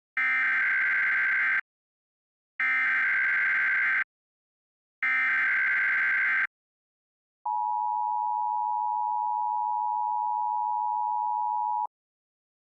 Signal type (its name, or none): Emergency Alert System (SAME) tones